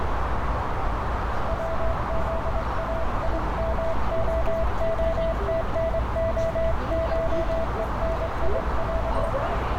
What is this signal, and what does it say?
Morse code (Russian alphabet), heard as a keyed tone, hand-sent with a straight key, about 23 wpm, 660 Hz, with heavy radio static, a narrow filter and street noise. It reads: ВЗАИМООТНОШЕНИЯ